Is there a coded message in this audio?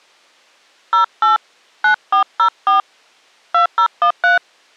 Yes: DTMF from 0.9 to 4.4 s, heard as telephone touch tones, dialled by hand, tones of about 120 ms. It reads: 08 9404 2013